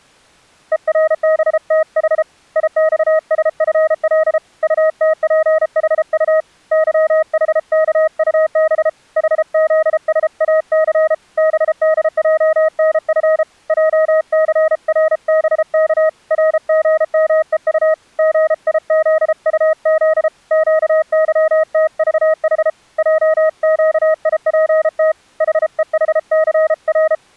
Morse code, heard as a keyed tone, hand-sent with a paddle, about 33 wpm, 630 Hz. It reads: ERBTH IXSFL UTPHU YHKUB HZSAC BDJNF JCRBK RGMEU GIZUZ QYTVH JQIPT HEHCR